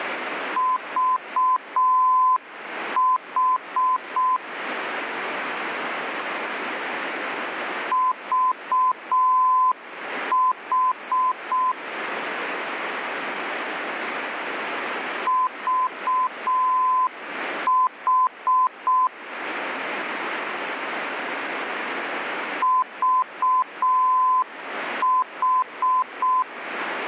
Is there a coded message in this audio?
Yes: Morse code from 0.5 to 26.5 s, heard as a keyed tone, machine-sent, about 6 wpm, 1020 Hz, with radio static. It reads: VH VH VH VH